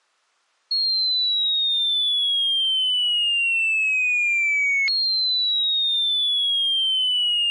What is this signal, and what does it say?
A tone that sweeps in pitch again and again. There is no code.